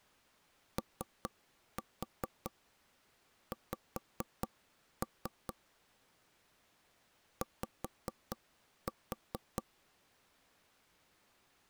Tap code, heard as knocks on wood, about 4 knocks a second. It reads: OX Y